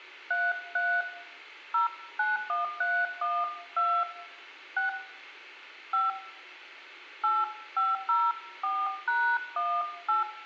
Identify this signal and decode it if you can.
DTMF, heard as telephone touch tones, dialled by hand, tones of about 220 ms, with room echo. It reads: 33 091312 6 5 8504#18